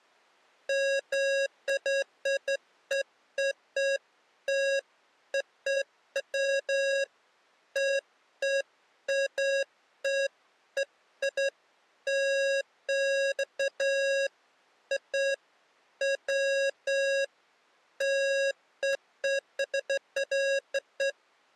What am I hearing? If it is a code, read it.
Beeps of irregular length. There is no code.